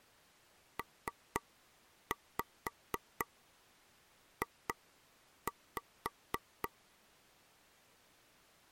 Tap code, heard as taps on a table, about 4 knocks a second. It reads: PJ